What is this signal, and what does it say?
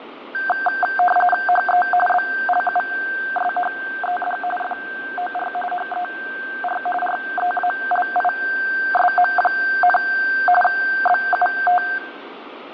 RTTY (45.45 baud, 850 Hz shift), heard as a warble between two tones, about 1140 Hz centre, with radio static and fading. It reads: HE BLUSHED FOR HER REALISM, BUT